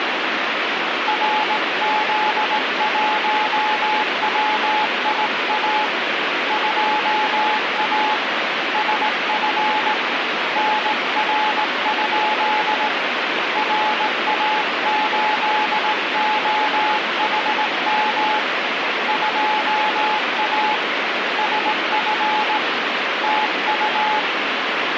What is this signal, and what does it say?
Morse code, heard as a keyed tone, hand-sent with a straight key, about 18 wpm, 860 Hz, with heavy radio static. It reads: RZ1WIA 2A SF NR? RA8OHM 2A SF TU